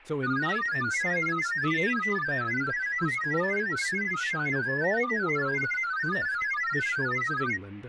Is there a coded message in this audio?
Yes: multi-tone FSK (Olivia or MFSK type), about 1000 Hz wide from 0.2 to 7.6 s, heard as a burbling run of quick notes, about 31.25 baud, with speech in English.